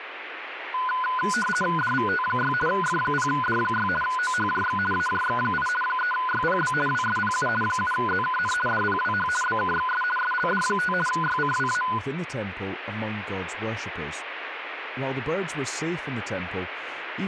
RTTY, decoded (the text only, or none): DVT6 F0D6 OHJX AJX8 3YPB WSPU 7ZKN DPWH BKXS SLD5 YCWA